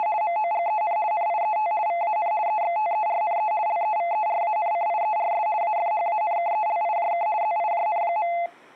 RTTY (50 baud, 170 Hz shift), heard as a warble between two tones, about 770 Hz centre. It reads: … MOGEN NIET VAN EXTERNE LEVERANCIERS AFHANKELIJK ZIJN.